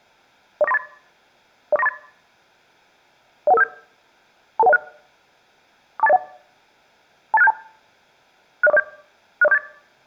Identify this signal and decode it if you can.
Five-tone selective call (EIA), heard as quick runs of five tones, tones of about 30 ms. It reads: 04938 04938 01157 22106 42801 28672 60407 60478